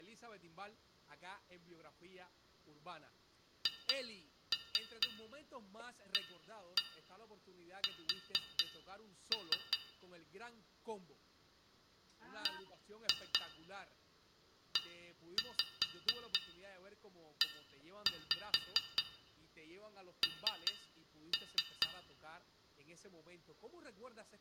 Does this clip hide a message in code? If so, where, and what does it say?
Yes: tap code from 3.7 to 22.0 s, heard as taps on a metal pipe, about 4 knocks a second, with room echo and speech in Spanish. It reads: HAS BEEN